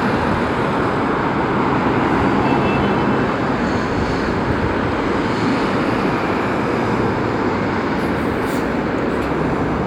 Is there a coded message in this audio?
No, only street noise.